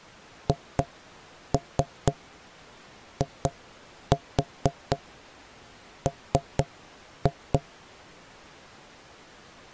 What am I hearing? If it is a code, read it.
Tap code, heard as knocks on wood, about 4 knocks a second. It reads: HIM